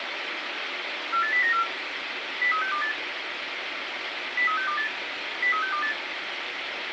Five-tone selective call (CCIR), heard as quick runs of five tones, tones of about 100 ms, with radio hiss and room echo. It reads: 48094 03628 03628 03628